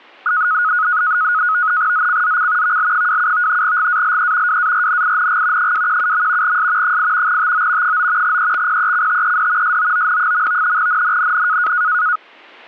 NAVTEX (SITOR-B), 100 baud, 170 Hz shift, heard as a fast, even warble, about 1360 Hz centre, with static crashes. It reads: ZCZC VL27 GALE WARNING 217. S 8 TO 9 EXPECTED SOON. NNNN